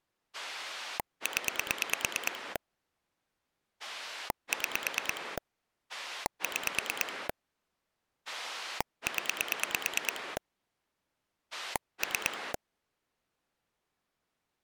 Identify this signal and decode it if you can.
Pulse dialling, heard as a rotary dial, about 9 pulses a second. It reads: 0 6 6 0 3